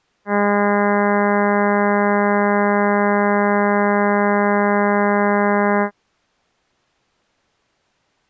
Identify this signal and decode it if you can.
Ship horn signal, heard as a ship's horn, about 200 Hz. 1 long. At sea: a vessel nearing a blind bend, or under power and making way in fog.